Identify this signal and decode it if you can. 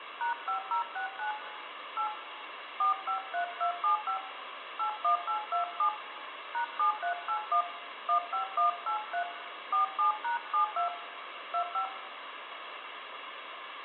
DTMF, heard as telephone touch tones, dialled by hand, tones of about 110 ms, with phone line noise and room echo. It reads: #5069 8 453275 81827 #7381 15183 47#72 25